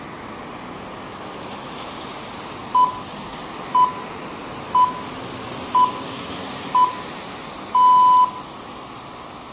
Radio time signal (six pips, as the Greenwich Time Signal), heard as pips, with room echo and street noise.